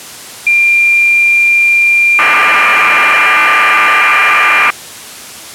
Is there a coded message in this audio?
Yes: cassette data (Kansas City type), 1200 baud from 0.5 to 4.7 s, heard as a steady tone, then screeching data.